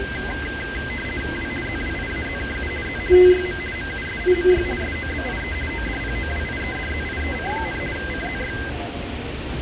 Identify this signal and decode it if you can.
RTTY (50 baud, 450 Hz shift), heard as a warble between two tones, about 1800 Hz centre, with radio static and street noise. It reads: W ZWIAZKU Z TYM MUSIMY SOBIE ODPOWIEDZIEC, CZY